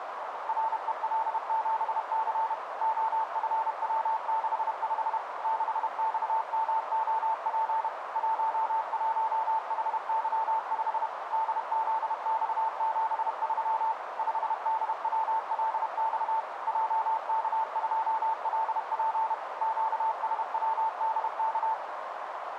Morse code, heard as a keyed tone, machine-sent, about 31 wpm, 890 Hz, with radio static and a narrow filter. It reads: REL7C OFW65 6XMOP 11HY5 DZX73 5DWLX JK2LP QSWDK